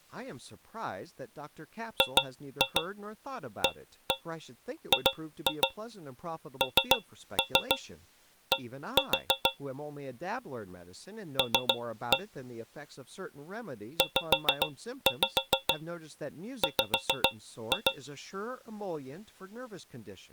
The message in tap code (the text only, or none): GAGND L ZW